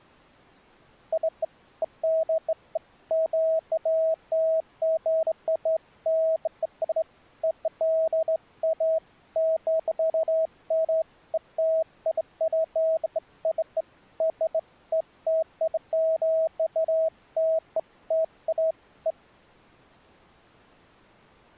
Beeps of irregular length. There is no code.